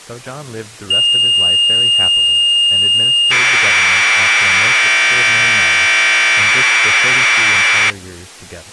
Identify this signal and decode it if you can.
Commodore tape loading (standard loader), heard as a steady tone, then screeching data, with speech in English.